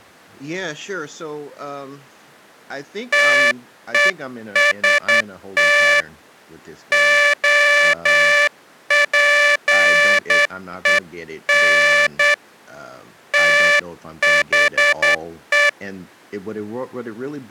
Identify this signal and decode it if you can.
Morse code, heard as a buzzer, hand-sent with a straight key, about 9 wpm, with speech in English. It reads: TEST OPEN THE